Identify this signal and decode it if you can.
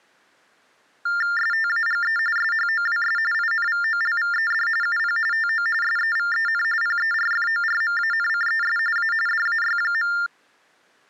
TTY/TDD text telephone tones (45.45 baud Baudot), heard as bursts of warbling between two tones, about 400 Hz shift, 1600 Hz centre. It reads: STAGE SHOWS INVOLVED UP TO SEVEN PERFORMANCES A DAY.